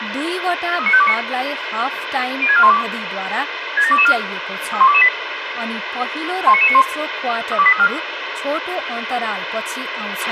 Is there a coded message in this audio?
Yes: five-tone selective call (ZVEI) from 0.8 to 7.9 s, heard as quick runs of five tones, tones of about 70 ms, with radio hiss, a squelch burst at the end, room echo and speech in Nepali. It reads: 39529 06412 67224 31228 19991 32834